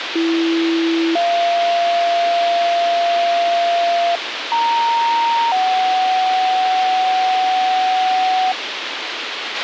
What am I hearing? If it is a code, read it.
Two-tone page, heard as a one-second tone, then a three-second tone, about 330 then 690 Hz, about 930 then 750 Hz, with radio hiss and a squelch burst at the end.